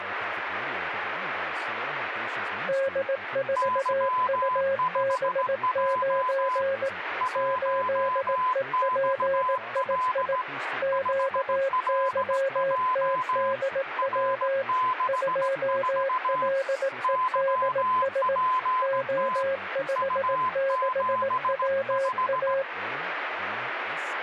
Morse code, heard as two keyed tones, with radio static and speech in English. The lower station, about 18 wpm, 540 Hz: D4UB9 8EPII QYTDW 2LEDS O56WA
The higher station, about 17 wpm, 1020 Hz: Y5J 1XL 5LJ R64 YPT U75